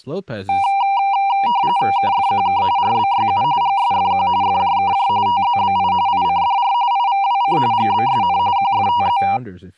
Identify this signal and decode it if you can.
RTTY (45.45 baud, 170 Hz shift), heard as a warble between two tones, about 880 Hz centre, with speech in English. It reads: KFQK RBYU GSFQ FJKJ TZBI ICDR IVWC GBSN QFTZ